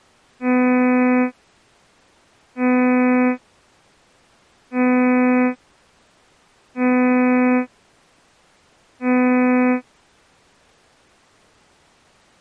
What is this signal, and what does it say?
Ship horn signal, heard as a ship's horn, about 250 Hz. 5 short. At sea: I doubt that you are doing enough to avoid a collision.